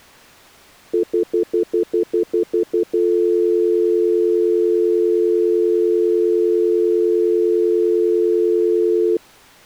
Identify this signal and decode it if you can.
Telephone call progress tone (North American plan), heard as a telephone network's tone, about 350, 440 Hz, 0.1 s on and 0.1 s off. Stutter dial tone.